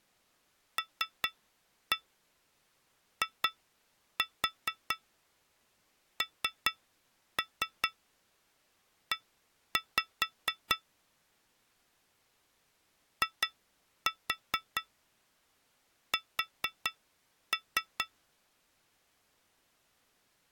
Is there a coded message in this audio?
Yes: tap code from 0.8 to 18.1 s, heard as taps on glass, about 4 knocks a second. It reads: LINE IS